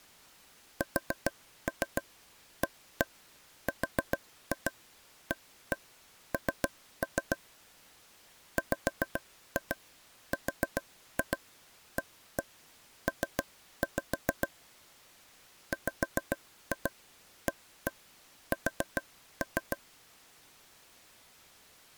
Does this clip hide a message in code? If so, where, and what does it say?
Yes: tap code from 0.8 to 19.8 s, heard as taps on a table, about 7 knocks a second. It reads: SARAN WRAP WAS